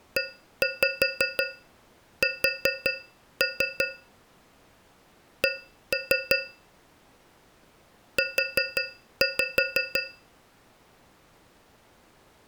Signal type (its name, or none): tap code